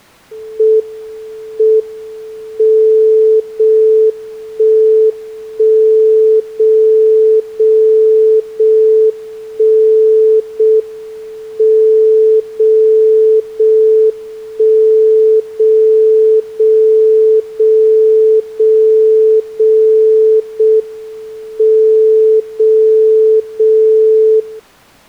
Radio time signal (JJY), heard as a tone whose level steps once a second, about 440 Hz. The time is 20:32 Japan time. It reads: M M 0 1 1 0 0 0 1 0 M 0 0 1 0 0 0 0 0 0 M 0 0 0